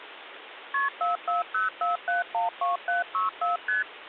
Multi-frequency trunk signalling (R1, as on North American trunks), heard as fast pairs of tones, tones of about 150 ms, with phone line noise. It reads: KP 4404712764 ST